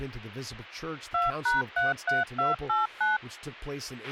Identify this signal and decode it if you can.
DTMF, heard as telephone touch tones, dialled by machine, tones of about 160 ms, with a squelch burst at the end and speech in English. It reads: 2#33289